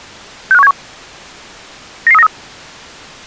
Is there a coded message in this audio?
Yes: five-tone selective call (EEA) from 0.5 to 2.3 s, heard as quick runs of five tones, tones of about 40 ms. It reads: 65171 99393